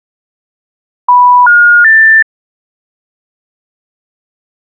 Telephone call progress tone (North American plan), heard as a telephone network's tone, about 980, 1430, 1800 Hz. Special information tone.